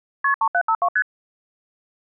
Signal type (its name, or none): multi-frequency trunk signalling